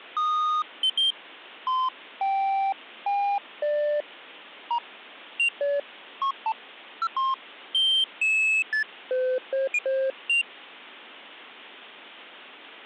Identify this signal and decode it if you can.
Electronic bleeps of random pitch and length. There is no code.